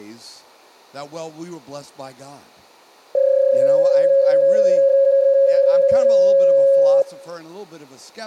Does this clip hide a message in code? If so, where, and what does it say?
Yes: PSK31 (31.25 baud) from 3.1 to 7.0 s, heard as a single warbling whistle, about 550 Hz, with speech in English.